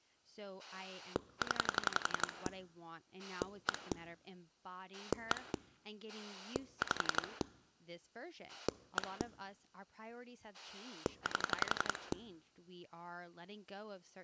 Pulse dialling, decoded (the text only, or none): 0 1 1 5 1 8